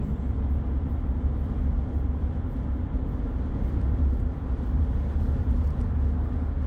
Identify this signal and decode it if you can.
The noise inside a car. There is no code.